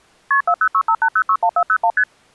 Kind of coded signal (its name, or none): multi-frequency trunk signalling